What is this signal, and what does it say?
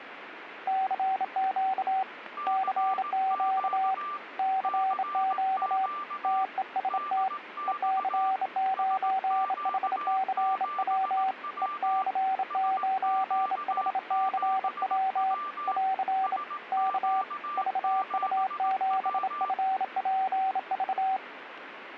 Morse code, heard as two keyed tones, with radio static. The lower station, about 27 wpm, 760 Hz: CQ CQ CQ TEST EC9HCW EC9HCW <AR> K VU7FPV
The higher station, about 18 wpm, 1180 Hz: CQ CQ DX SQ7W SQ7W SQ7W